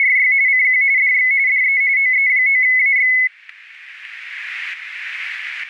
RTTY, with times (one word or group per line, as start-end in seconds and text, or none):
0.0-0.3 …
0.5-0.8 CQ
1.0-1.3 DX
1.5-1.8 DE
2.0-3.1 OE9AX